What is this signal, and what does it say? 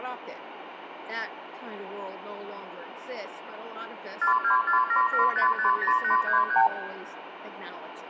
Multi-frequency trunk signalling (R2, with the far end's replies), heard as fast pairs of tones, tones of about 110 ms, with phone line noise and room echo. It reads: 42477550833